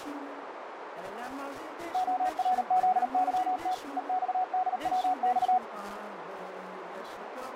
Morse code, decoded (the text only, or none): ORZYT EXDWX